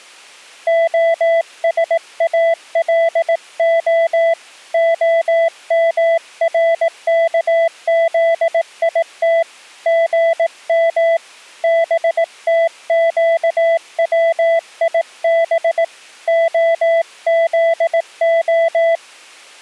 Morse code (Hebrew alphabet), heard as a keyed tone, hand-sent with a paddle, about 18 wpm, 660 Hz. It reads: השאלה המרכזית גם בתקציב הזה